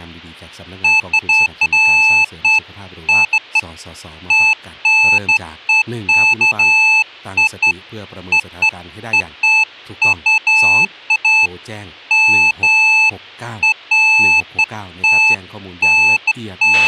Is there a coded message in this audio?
No, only beeps of irregular length, with a squelch burst at the end and speech in Thai.